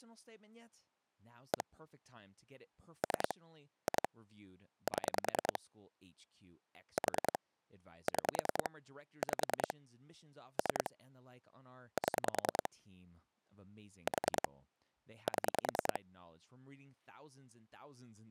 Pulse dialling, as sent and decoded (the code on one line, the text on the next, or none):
1 / 3 / 2 / 7 / 4 / 6 / 5 / 3 / 7 / 4 / 7
1 3 2 7 4 6 5 3 7 4 7